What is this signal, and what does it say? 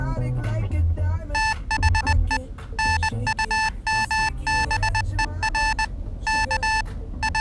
Morse code, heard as electronic beeps, machine-sent, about 20 wpm, 880 Hz, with the noise inside a car. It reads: THE NUMBER K …